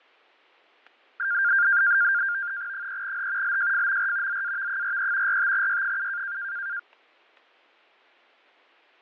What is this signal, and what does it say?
NAVTEX (SITOR-B), 100 baud, 170 Hz shift, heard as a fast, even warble, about 1500 Hz centre, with fading. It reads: 3H LJFMR ZAV43 45Y7